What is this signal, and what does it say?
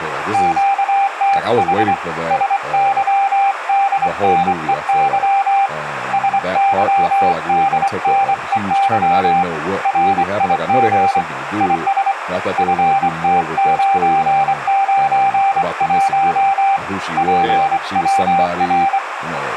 Morse code, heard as a keyed tone, hand-sent with a straight key, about 24 wpm, 790 Hz, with radio static, a narrow filter and speech in English. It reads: QTH SYDNEY SYDNEY RIG IS FT991 PWR